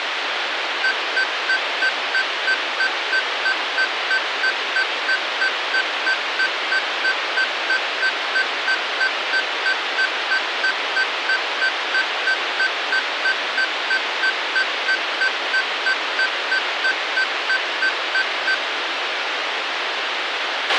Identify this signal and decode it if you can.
Evenly repeated beeps, with radio hiss and a squelch burst at the end. There is no code.